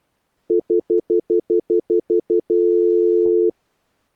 Telephone call progress tone (North American plan), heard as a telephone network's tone, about 350, 440 Hz, 0.1 s on and 0.1 s off. Stutter dial tone.